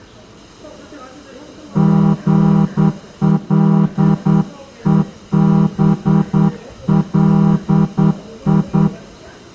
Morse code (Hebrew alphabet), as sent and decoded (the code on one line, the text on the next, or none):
--. .-.. . -... .-.. ..
גלובלי